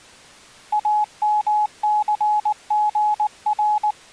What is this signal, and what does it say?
Morse code, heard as a keyed tone, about 19 wpm, 840 Hz. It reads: AMCGR